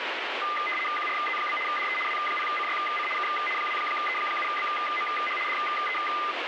RTTY (75 baud, 850 Hz shift), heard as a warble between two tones, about 1600 Hz centre, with radio static. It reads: QRZ? DE W0CYC K 2E7BMH DE